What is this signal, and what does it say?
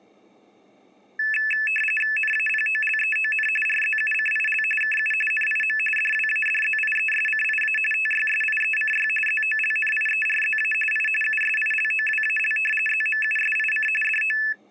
RTTY (45.45 baud, 850 Hz shift), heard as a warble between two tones, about 2150 Hz centre. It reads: NAPOLEON RZUCIL KU NIM DWADZIESCIA TYSIECY ZOLNIERZA I USILOWAL ZMUSIC DO